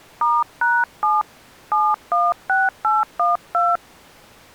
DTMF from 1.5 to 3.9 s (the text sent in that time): 716812